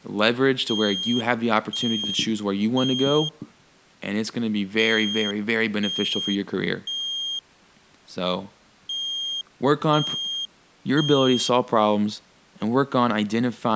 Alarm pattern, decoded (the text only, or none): temporal three